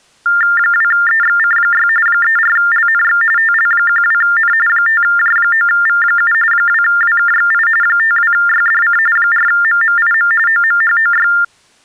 TTY/TDD text telephone tones (45.45 baud Baudot), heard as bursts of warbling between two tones, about 400 Hz shift, 1600 Hz centre. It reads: 2EXC6 34LNX TL12N 5J9V7 2WKXI 52YDC 4MMIM OMHOY